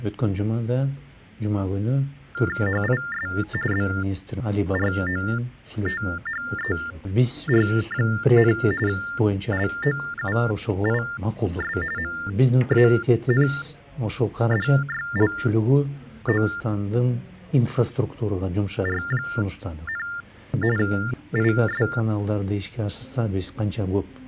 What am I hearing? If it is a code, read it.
TTY/TDD text telephone tones (45.45 baud Baudot), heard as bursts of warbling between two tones, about 400 Hz shift, 1600 Hz centre. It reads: HIS BROTHER, LOUIS MANDYLOR, IS